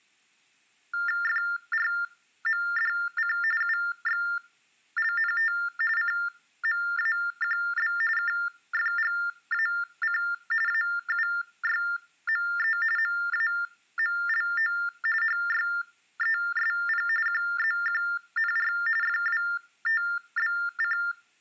TTY/TDD text telephone tones (45.45 baud Baudot), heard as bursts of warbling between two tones, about 400 Hz shift, 1600 Hz centre. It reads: FRMDC UXLNT CMAQB KFGAC AUYME MAMLO HYESP QZQNR FWTBC